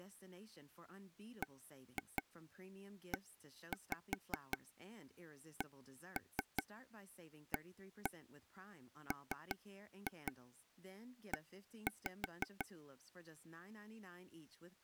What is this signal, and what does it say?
Tap code, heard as taps on a table, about 5 knocks a second, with speech in English. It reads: BECAME